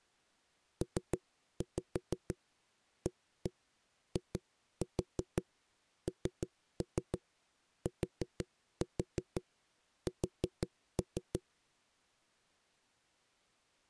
Tap code, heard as knocks on a wall, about 6 knocks a second. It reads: PAINTS